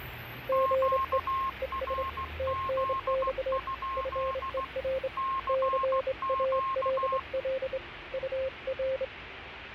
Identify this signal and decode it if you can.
Morse code, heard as two keyed tones, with radio static and street noise. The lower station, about 26 wpm, 530 Hz: GE ES TNX FER CALL UR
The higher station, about 16 wpm, 1070 Hz: QRZ? CQ